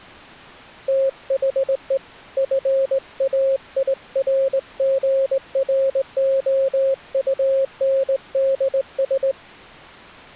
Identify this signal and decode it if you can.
Morse code, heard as a keyed tone, hand-sent with a straight key, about 19 wpm, 540 Hz. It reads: THE FAIRGROUNDS